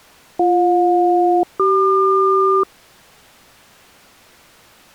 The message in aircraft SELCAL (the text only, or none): BJ-CQ